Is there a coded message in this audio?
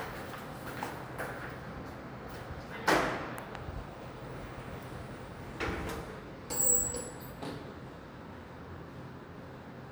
No, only the noise inside a lift.